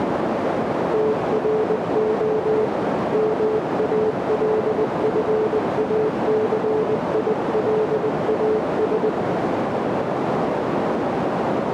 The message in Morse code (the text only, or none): TRO MALFACILAS